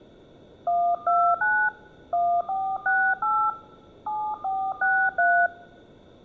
DTMF, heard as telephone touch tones, dialled by hand, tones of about 280 ms. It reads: 129 1468 7463